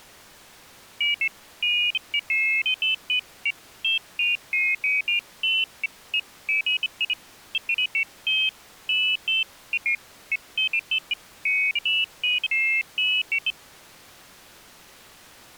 Pairs of high tones at irregular times. There is no code.